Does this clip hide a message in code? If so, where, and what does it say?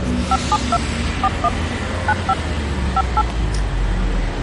Yes: DTMF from 0.3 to 3.2 s, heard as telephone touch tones, dialled by machine, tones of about 50 ms, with street noise. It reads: 572 41 95 58